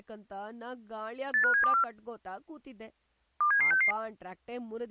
Five-tone selective call (CCIR), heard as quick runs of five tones, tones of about 100 ms, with speech in Kannada. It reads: 85724 27766